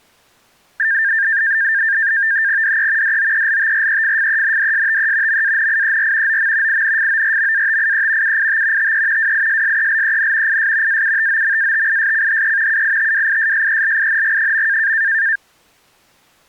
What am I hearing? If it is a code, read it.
NAVTEX (SITOR-B), 100 baud, 170 Hz shift, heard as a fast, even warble, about 1700 Hz centre. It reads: DE DOELTREFFENDSTE MANIER OM INFORMATIE UIT TE WISSELEN IS AUTOMATISCHE UITWISSELING.